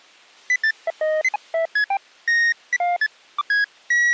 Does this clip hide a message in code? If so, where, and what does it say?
No, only electronic bleeps of random pitch and length.